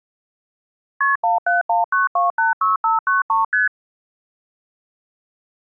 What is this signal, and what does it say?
Multi-frequency trunk signalling (R1, as on North American trunks), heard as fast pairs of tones, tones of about 150 ms. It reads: KP 1719286593 ST